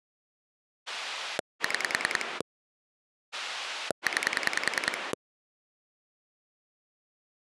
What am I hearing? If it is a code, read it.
Pulse dialling, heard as a rotary dial, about 10 pulses a second. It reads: 6 9